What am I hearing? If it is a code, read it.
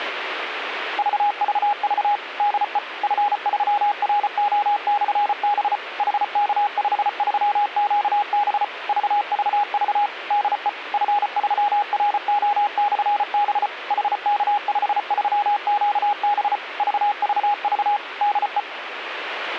Morse code, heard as a keyed tone, machine-sent, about 34 wpm, 820 Hz, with radio static. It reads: VVV DE F3RO/B HK53QB VVV DE F3RO/B HK53QB VVV DE